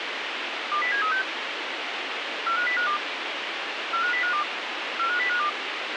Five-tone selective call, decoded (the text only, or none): 20736 45052 45052 45052